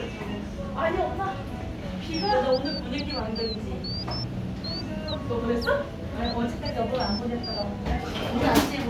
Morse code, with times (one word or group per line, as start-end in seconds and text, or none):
none